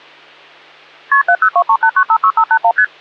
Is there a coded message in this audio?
Yes: multi-frequency trunk signalling (R1, as on North American trunks) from 1.1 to 2.8 s, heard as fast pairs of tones, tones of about 70 ms, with hum. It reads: KP 70238956581 ST